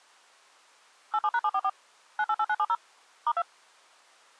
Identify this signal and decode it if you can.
DTMF, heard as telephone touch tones, dialled by machine, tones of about 50 ms. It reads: 87#744 988970 *2